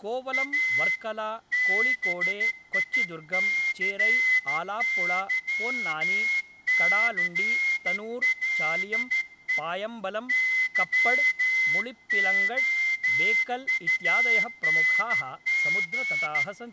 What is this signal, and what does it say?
Morse code, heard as a whistle, hand-sent with a straight key, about 13 wpm, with room echo and speech in Sanskrit. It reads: A BICYCLE YOUNG